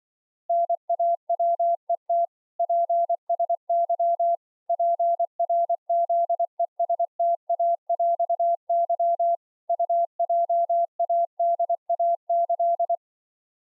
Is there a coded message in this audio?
Yes: Morse code (with Polish letters) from 0.4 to 13.0 s, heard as a keyed tone, machine-sent, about 24 wpm, 680 Hz. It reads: NAWET PSY PRZESTAŁY UJADAĆ